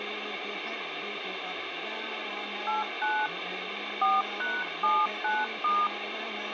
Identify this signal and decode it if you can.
DTMF, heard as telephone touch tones, dialled by hand, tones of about 200 ms, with phone line noise and room echo. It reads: 89 4#79*